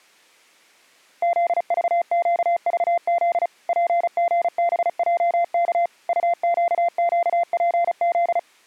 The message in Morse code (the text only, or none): ZVQVZ PGBJK UQQPZ